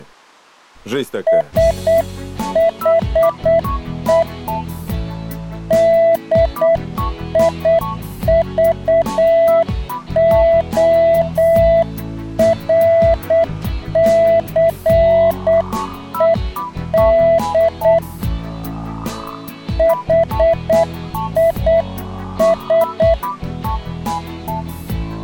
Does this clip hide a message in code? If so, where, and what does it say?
Yes: Morse code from 1.2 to 23.2 s, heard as a keyed tone, hand-sent with a paddle, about 8 wpm, 660 Hz. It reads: SHE DIVORCED HIS